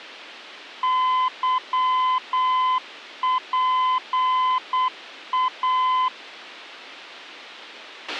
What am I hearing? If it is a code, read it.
Morse code, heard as a keyed tone, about 8 wpm, 1020 Hz, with a squelch burst at the end. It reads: YPA